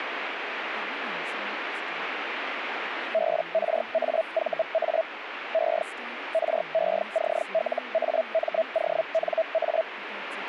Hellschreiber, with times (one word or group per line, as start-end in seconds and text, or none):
3.1-5.0 BRAVA
5.5-5.8 E
6.3-9.8 RECLAMONA